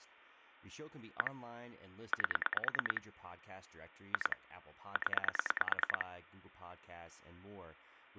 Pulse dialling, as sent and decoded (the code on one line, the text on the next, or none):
1 / 8 / 2 / 10
1 8 2 0